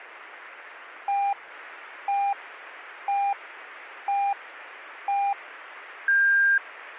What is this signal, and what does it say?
Radio time signal (five pips and a higher one, as on Chinese radio), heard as pips.